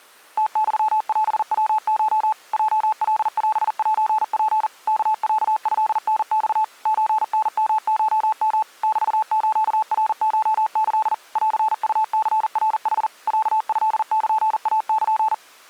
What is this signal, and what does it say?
Morse code (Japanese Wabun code), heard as a keyed tone, machine-sent, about 40 wpm, 870 Hz. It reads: ムユオヤコ ヲカオセツ ワロトタマ ソタヨコヨ メスナコキ ンウニナヌ ロトルイル